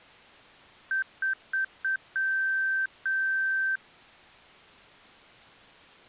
Beep code, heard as beeps from a small speaker, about 1550 Hz. 4 short, 2 long.